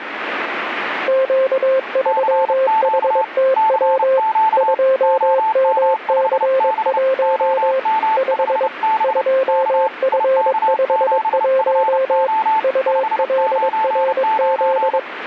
Morse code, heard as two keyed tones, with radio static. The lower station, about 22 wpm, 530 Hz: Q3HTW 2MC1 5 2F51 ULRZ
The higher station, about 30 wpm, 880 Hz: CQ CQ OM5B OM5B K IK7FO 599